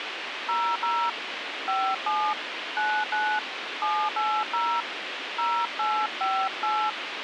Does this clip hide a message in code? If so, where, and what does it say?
Yes: DTMF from 0.5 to 6.9 s, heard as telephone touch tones, dialled by hand, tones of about 270 ms, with radio hiss. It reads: 00 57 99 780 0858